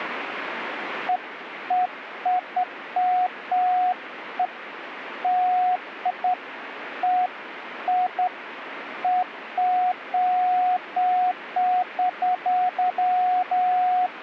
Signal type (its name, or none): none